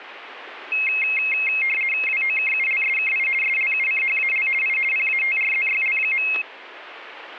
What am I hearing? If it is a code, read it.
RTTY (50 baud, 450 Hz shift), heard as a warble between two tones, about 2350 Hz centre, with static crashes. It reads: WOKULSKI SLUCHAL I PATRZYL.